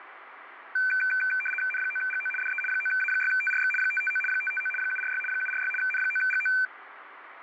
RTTY (75 baud, 850 Hz shift), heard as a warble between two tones, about 1950 Hz centre, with radio static. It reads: N9GO DE 9A6TRX 559 559 746 746 N9GO